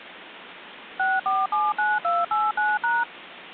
DTMF, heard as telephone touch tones, dialled by machine, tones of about 200 ms. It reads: 6479289#